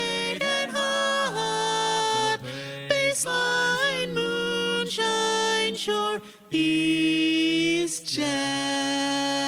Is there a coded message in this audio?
No.